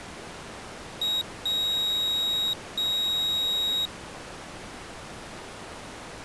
Beep code, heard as a piezo beeper, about 3800 Hz. 1 short, 2 long.